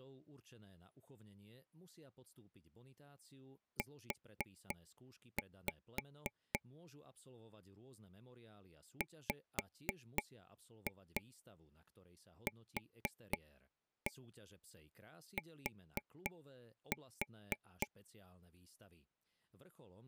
Tap code, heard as taps on a table, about 3 knocks a second, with speech in Slovak. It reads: U WQT